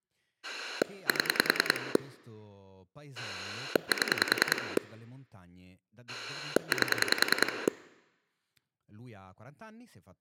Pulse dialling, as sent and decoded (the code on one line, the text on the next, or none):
7 / 7 / 8
7 7 8